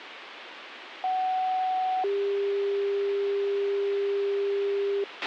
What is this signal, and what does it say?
Two-tone page, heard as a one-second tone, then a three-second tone, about 750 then 400 Hz, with radio hiss and a squelch burst at the end.